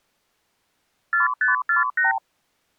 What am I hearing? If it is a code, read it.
Multi-frequency trunk signalling (R2, with the far end's replies), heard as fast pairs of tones, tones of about 140 ms. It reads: 4548